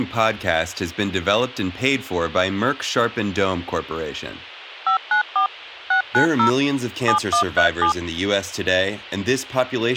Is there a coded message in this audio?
Yes: DTMF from 4.9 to 7.9 s, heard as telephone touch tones, dialled by machine, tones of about 100 ms, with speech in English. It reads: 594 690 7137